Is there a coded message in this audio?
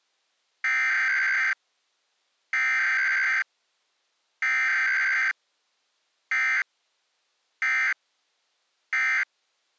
Yes: Emergency Alert System (SAME) tones (header bursts, then end-of-message bursts) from 0.6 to 9.2 s, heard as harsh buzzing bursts, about 520.83 baud.